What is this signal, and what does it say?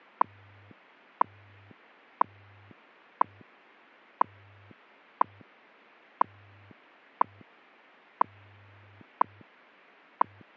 Radio time signal (WWV, Colorado), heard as ticks, one a second.